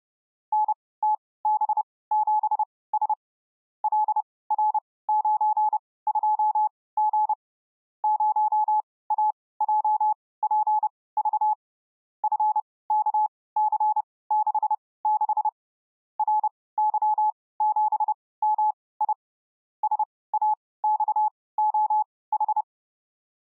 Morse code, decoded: NTB7S LR92G 0AJPV FKC66 RY7MI SAXOH

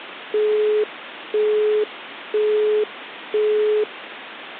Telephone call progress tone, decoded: busy tone

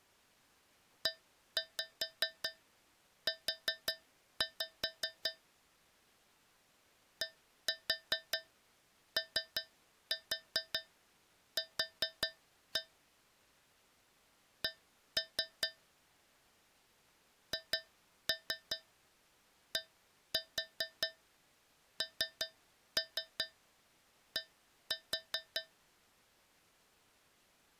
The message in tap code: EU DOQ C HDND

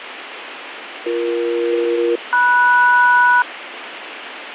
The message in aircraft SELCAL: BE-MS

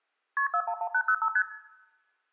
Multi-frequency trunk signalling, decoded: KP 411805 ST

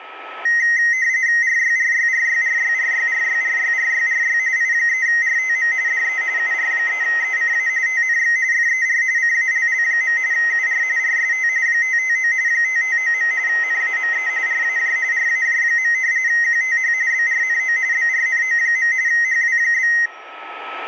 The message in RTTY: RYRYRYRYRYRYRYRYRY I3RTM DE UR3ECA TNX FER CALL. UR RST 559 559. NAME RAJ RAJ. QTH BRNO BRNO. HW?

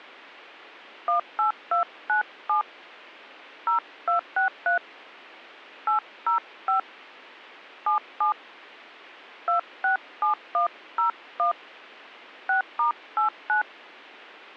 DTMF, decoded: 18297 0263 805 77 267101 6*89

